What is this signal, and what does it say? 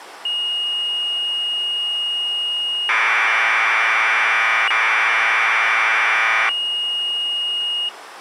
Commodore tape loading (standard loader), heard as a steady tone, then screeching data.